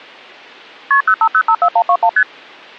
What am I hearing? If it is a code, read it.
Multi-frequency trunk signalling (R1, as on North American trunks), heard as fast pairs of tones, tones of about 70 ms. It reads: KP 05054121 ST